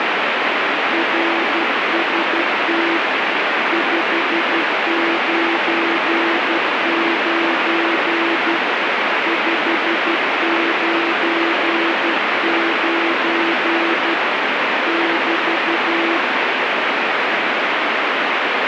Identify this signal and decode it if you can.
Morse code, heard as a keyed tone, hand-sent with a paddle, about 12 wpm, 340 Hz, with heavy radio static. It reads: RST 599 599 <BT>